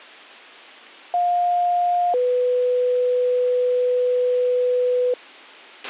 Two-tone page, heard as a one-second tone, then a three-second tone, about 710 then 500 Hz, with a squelch burst at the end.